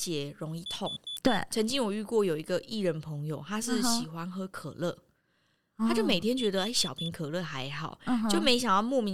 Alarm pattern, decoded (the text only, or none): temporal four